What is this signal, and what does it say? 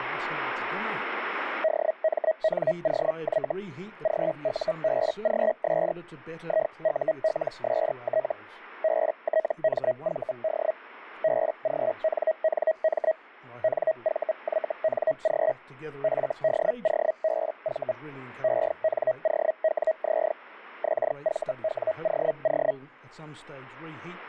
Hellschreiber (Feld-Hell, 122.5 baud), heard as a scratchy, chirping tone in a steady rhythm, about 640 Hz. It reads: DMNOY GUBGS IULST BTMVD BGNNM NVYNG FDOBV ENOWZ XVWOO